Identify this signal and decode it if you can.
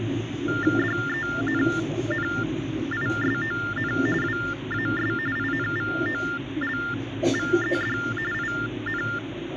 TTY/TDD text telephone tones (45.45 baud Baudot), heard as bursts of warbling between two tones, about 400 Hz shift, 1600 Hz centre, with phone line noise and the noise inside a subway train. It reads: DENNISON WAS INVOLVED IN